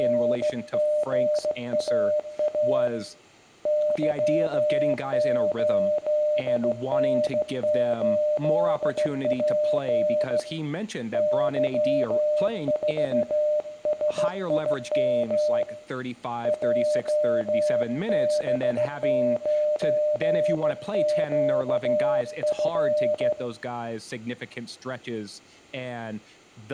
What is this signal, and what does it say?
Morse code, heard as a keyed tone, hand-sent with a straight key, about 15 wpm, 600 Hz, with room echo and speech in English. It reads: … Y8N8P Y4SIM JB9QF